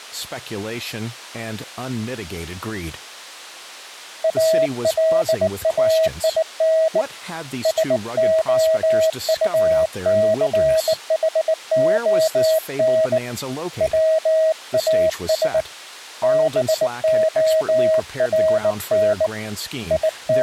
Morse code, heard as a keyed tone, hand-sent with a bug key, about 19 wpm, 640 Hz, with speech in English. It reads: ALAIN SOUCHON WAS BORN …